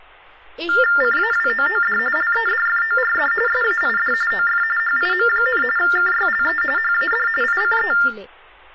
TTY/TDD text telephone tones (45.45 baud Baudot), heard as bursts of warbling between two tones, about 400 Hz shift, 1600 Hz centre, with speech in Odia. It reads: CAWOOD LEDFORD SAID OF HIM, KYLE HAD ICE